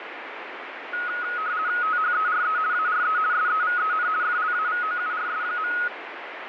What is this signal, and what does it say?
RTTY (50 baud, 170 Hz shift), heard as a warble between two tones, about 1360 Hz centre, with radio static. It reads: THERE ARE SEVEN FLAVOURS.